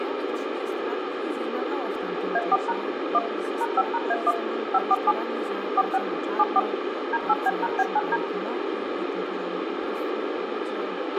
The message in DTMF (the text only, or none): A4# 1 #5#A1 547 46 74 D8B#B9D